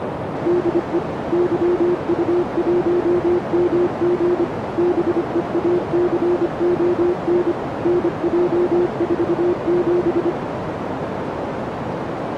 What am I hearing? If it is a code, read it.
Morse code, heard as a keyed tone, machine-sent, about 25 wpm, 350 Hz, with radio static and a narrow filter. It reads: DE YU1MG BEACON NJ47